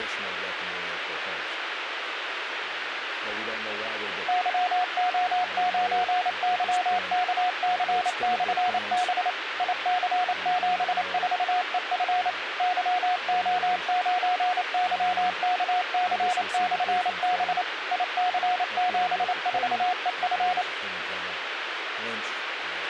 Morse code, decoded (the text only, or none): YO9YKC/B IC74EF YO9YKC/B IC74EF